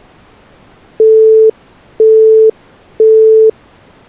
Telephone call progress tone (single-tone plan, as in Europe, Japan and elsewhere), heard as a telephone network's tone, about 440 Hz, 0.5 s on and 0.5 s off. Busy tone.